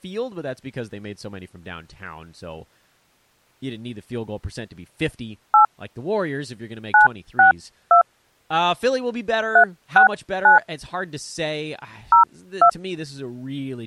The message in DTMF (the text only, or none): 8 962 369 02